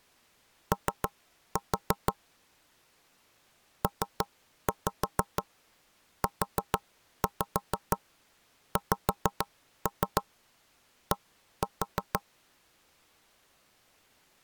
Tap code, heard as knocks on wood, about 6 knocks a second. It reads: O PUXD